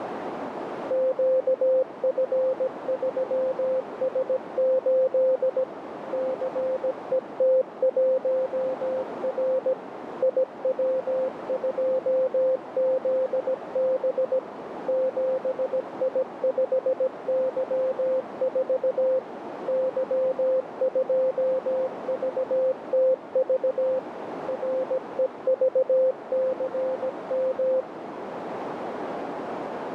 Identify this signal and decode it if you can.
Morse code, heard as a keyed tone, machine-sent, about 17 wpm, 520 Hz, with radio static and a narrow filter. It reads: QF3S8 CET1R IW2ZB 7I5Y4 Y2VTV REVCM